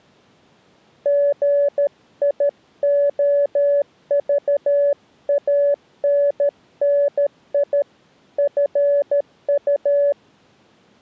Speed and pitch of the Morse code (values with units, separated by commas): 13 wpm, 570 Hz